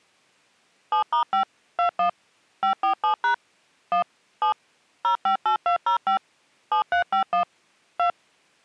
DTMF, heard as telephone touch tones, dialled by machine, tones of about 100 ms. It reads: 7*5 21 547# 1 7 058205 7351 2